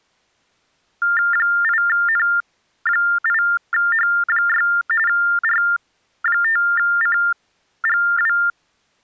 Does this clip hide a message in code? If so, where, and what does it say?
Yes: TTY/TDD text telephone tones (45.45 baud Baudot) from 1.0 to 8.5 s, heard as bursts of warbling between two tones, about 400 Hz shift, 1600 Hz centre. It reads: 8N8H6 R5CGW